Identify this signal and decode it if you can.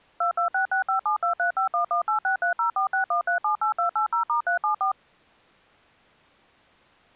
DTMF, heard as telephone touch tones, dialled by machine, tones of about 110 ms. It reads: 226657235118630461378280*374